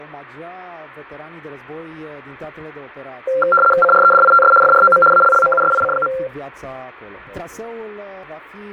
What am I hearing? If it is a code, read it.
RTTY (75 baud, 850 Hz shift), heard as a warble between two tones, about 950 Hz centre, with radio static and fading. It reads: CREDITS FROM ALLMUSIC.